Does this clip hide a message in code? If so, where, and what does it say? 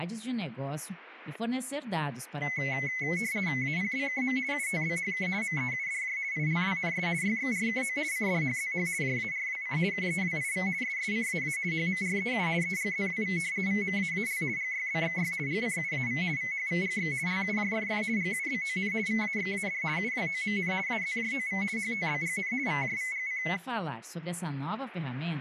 Yes: RTTY (50 baud, 170 Hz shift) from 2.4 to 23.6 s, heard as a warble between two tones, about 2100 Hz centre, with static crashes. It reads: APBKM UTBHK MEUDJ ILWNS YXRKO CDHZH JARWC KEWIV SSCAA HMREU EGZWV VMAAL GYBXY GCUAV VHVGX LUJFF GUBON VAXAD UWOMN AZJOV HTBGN VJVGC